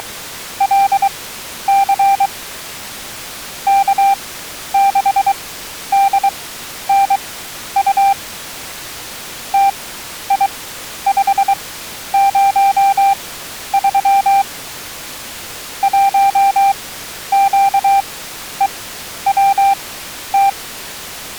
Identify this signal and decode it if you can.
Morse code, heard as a keyed tone, machine-sent, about 23 wpm, spaced as for 11 wpm, 790 Hz. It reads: … K6DNU TI503 1QEWT